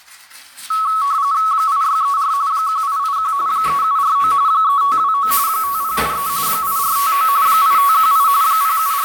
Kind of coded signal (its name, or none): RTTY